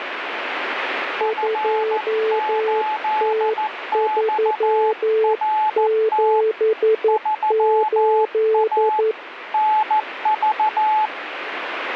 Morse code, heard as two keyed tones, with radio static. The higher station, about 14 wpm, 860 Hz: F8XRT 3A NV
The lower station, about 11 wpm, 440 Hz: 2T378